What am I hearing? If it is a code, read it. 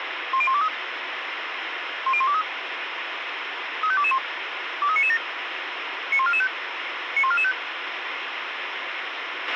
Five-tone selective call (ZVEI), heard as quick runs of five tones, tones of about 70 ms, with radio hiss and a squelch burst at the end. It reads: 10123 10123 35221 23997 91445 91445